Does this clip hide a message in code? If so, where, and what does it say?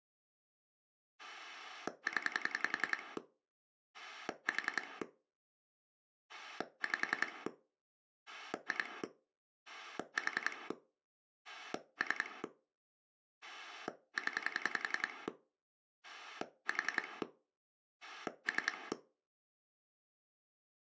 Yes: pulse dialling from 1.2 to 18.9 s, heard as a rotary dial, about 10 pulses a second. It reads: 0 4 5 2 4 3 0 4 3